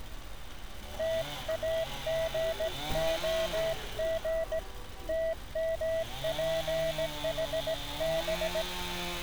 Morse code, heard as a keyed tone, hand-sent with a straight key, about 17 wpm, 650 Hz, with street noise. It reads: TAGOG TMPHB